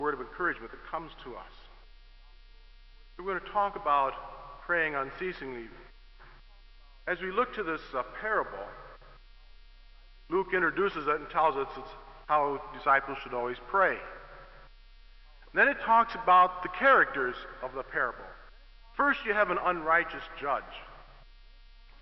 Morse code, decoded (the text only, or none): none